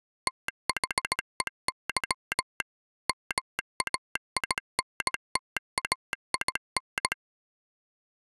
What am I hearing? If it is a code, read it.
Morse code, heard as a telegraph sounder, machine-sent, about 17 wpm. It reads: THEY MAINTAIN